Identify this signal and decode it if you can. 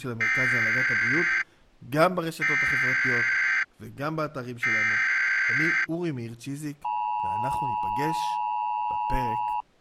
Emergency Alert System (SAME) tones (header bursts, then the 853 and 960 Hz attention tone), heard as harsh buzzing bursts, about 520.83 baud, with speech in Hebrew.